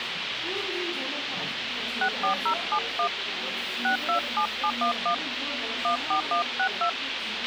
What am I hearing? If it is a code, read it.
DTMF, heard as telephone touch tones, dialled by hand, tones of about 100 ms, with radio hiss, a squelch burst at the end and the noise of a cafe. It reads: 64071 627711 14162